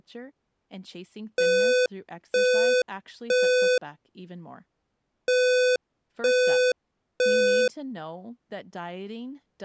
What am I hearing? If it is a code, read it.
Alarm pattern, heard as an alarm's beeps, played twice, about 500 Hz, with speech in English. Temporal three. Smoke or fire, evacuate.